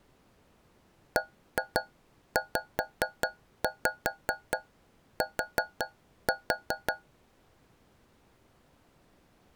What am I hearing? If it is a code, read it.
Tap code, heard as taps on a metal pipe, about 5 knocks a second. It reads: BZT